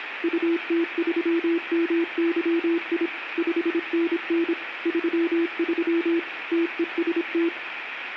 Morse code, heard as a keyed tone, machine-sent, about 26 wpm, 340 Hz. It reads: UT3MYI 5NN 33 TEST